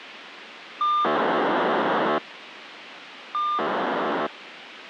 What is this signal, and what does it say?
POCSAG pager data (2400 baud), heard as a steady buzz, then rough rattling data, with radio hiss.